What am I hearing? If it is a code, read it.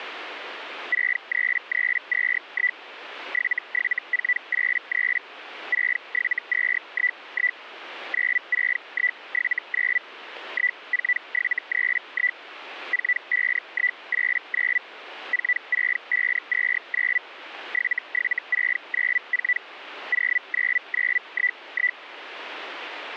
Hellschreiber (Feld-Hell, 122.5 baud), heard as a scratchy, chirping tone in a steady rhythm, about 2000 Hz. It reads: 63321 77483 67211 96179 14731 45189 46529 77694 09911